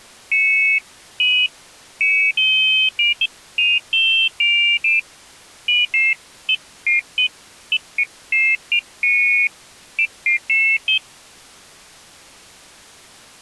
Pairs of high tones at irregular times. There is no code.